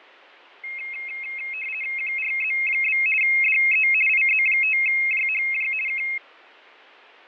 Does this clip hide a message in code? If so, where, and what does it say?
Yes: RTTY (50 baud, 450 Hz shift) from 0.6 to 6.2 s, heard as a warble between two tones, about 2350 Hz centre, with fading. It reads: QRZ? DE IZ5JHJ K